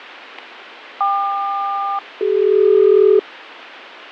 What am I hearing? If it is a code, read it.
Aircraft SELCAL, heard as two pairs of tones, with radio static and fading. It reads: KQ-CD